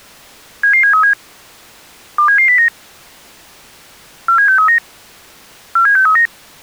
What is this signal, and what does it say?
Five-tone selective call (CCIR), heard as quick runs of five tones, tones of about 100 ms. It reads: 77737 27709 47639 47639